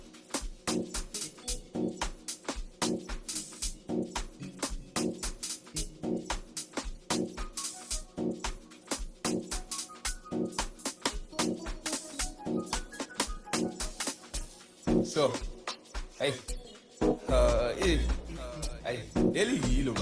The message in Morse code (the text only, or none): none